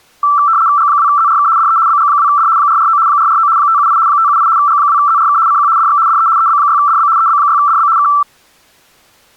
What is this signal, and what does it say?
RTTY (75 baud, 170 Hz shift), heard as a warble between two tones, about 1240 Hz centre. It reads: G2ZRK DE BG2D 449 449 578 578 G2ZRK CQ DX DE EB6DB EB6DB K